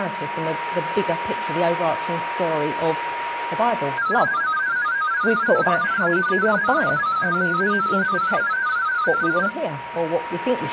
Multi-tone FSK (Olivia or MFSK type), about 500 Hz wide, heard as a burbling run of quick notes, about 31.25 baud, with a steady whistle near 950 Hz.